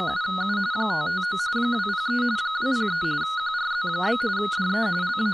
RTTY (45.45 baud, 170 Hz shift), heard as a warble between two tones, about 1360 Hz centre, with speech in English. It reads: … 559 203 203 QRZ? DE …